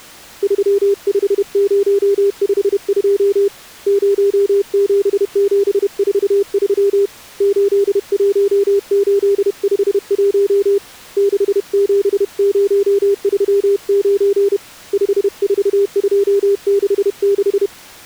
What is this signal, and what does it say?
Morse code, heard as a keyed tone, hand-sent with a paddle, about 31 wpm, 400 Hz. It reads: 35052 07743 81851 67039 54266